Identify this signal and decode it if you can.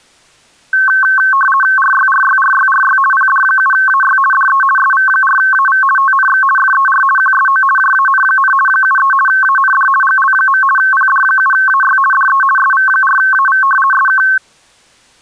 RTTY (50 baud, 450 Hz shift), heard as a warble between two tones, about 1310 Hz centre. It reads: RYRYRYRY PD7AY DE SV4AV TNX FER QSO JAN, 73 AND GL. PD7AY DE SV4AV SK